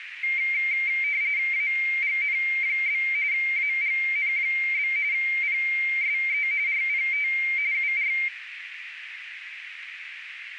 RTTY (45.45 baud, 170 Hz shift), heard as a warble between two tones, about 2200 Hz centre, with radio static and a narrow filter. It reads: AGN? AGN? PSE RPT UR